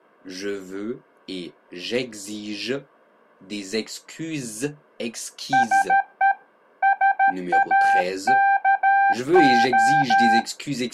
Morse code, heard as a keyed tone, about 13 wpm, 790 Hz. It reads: SE SAKO